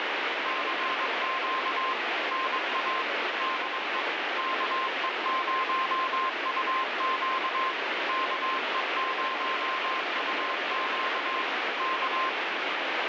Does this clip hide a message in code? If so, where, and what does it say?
Yes: Morse code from 0.4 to 12.4 s, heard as a keyed tone, machine-sent, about 22 wpm, 1050 Hz, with heavy radio static. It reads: CQ NA DE KE0UQ KE0UQ K